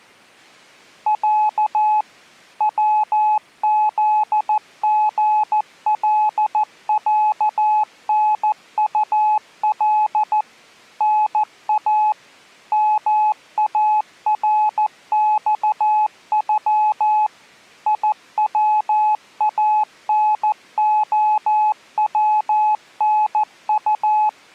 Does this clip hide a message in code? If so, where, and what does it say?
Yes: Morse code (Russian alphabet) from 1.0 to 24.4 s, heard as a keyed tone, machine-sent, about 14 wpm, 850 Hz. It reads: Я ВЗГЛЯНУЛ НА МАРЬЮ ИВАНОВНУ